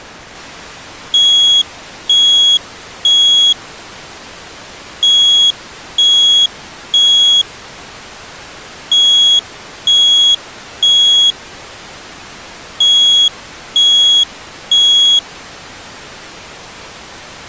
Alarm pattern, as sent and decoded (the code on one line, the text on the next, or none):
3 beeps and a pause
temporal three